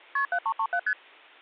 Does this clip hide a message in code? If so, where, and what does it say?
Yes: multi-frequency trunk signalling (R1, as on North American trunks) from 0.2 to 0.9 s, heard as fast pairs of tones, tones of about 70 ms. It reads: KP 7337 ST